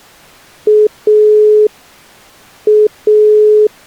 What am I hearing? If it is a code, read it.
Telephone call progress tone (pulsed, as in Italy), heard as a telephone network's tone, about 420 Hz. Dial tone.